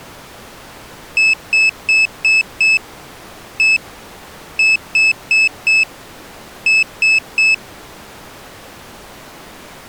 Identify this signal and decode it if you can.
Beep code, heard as a piezo beeper, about 2600 Hz. 5-1-4-3.